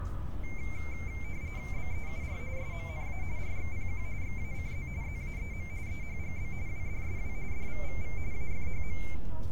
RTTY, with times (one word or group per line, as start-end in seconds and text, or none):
1.7-2.4 BEUR
2.6-3.2 SMNA
3.4-4.0 RXPQ
4.2-4.9 XACZ
5.0-5.7 ZAEM
5.9-6.5 EHGB
6.7-7.4 WDSW
7.5-8.2 DVVV
8.3-9.0 AFHM